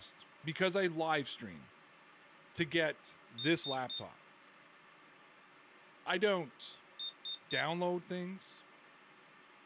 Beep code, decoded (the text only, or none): 3 short